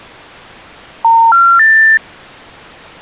Telephone call progress tone (North American plan), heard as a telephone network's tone, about 910, 1370, 1800 Hz. Special information tone.